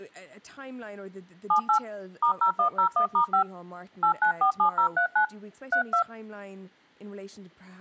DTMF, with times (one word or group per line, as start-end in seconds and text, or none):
1.5-1.8 78
2.2-3.4 *0101*5
4.0-5.3 8947039
5.7-6.0 32